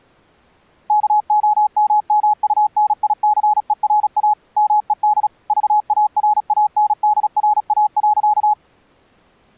Morse code, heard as a keyed tone, machine-sent, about 36 wpm, 840 Hz. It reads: KOMMUNICERA MED VARANDRA.